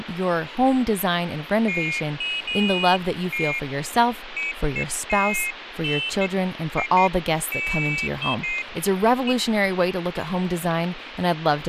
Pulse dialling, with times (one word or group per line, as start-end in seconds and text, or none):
none